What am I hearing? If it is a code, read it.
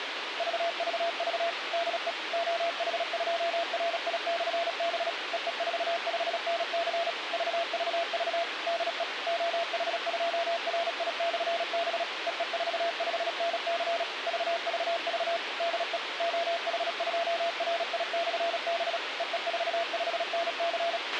Morse code, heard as a keyed tone, machine-sent, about 36 wpm, 680 Hz, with radio hiss and a squelch burst at the end. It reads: VVV DE OH2RI/B EE45NC VVV DE OH2RI/B EE45NC VVV DE OH2RI/B EE45NC